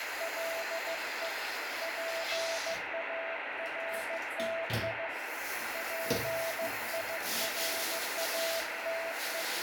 Morse code, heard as a keyed tone, hand-sent with a paddle, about 15 wpm, 660 Hz, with heavy radio static and the noise of a restroom. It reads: LE PARTI PIRATE